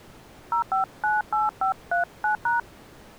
DTMF, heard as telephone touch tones, dialled by hand, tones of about 160 ms. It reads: 0598539#